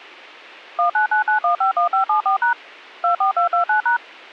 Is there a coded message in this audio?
Yes: DTMF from 0.8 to 4.0 s, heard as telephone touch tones, dialled by machine, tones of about 110 ms. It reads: 1999151574# 24229#